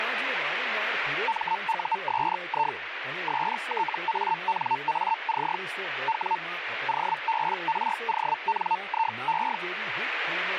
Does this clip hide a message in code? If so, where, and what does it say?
Yes: Hellschreiber (Feld-Hell, 122.5 baud) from 1.3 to 9.6 s, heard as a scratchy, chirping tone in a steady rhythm, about 900 Hz, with radio static and speech in Gujarati. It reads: MUSI STANAC W OBRONIE